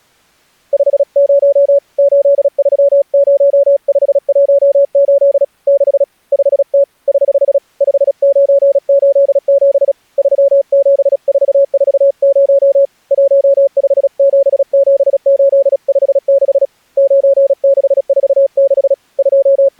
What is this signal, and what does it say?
Morse code, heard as a keyed tone, hand-sent with a paddle, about 36 wpm, 560 Hz. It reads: 50 830518 6 5T <HH> 5987 37440 1577856 9646 …